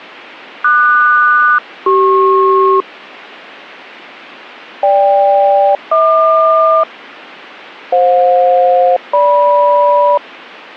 Aircraft SELCAL, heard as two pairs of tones. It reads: QS-CP GK-HQ FJ-GM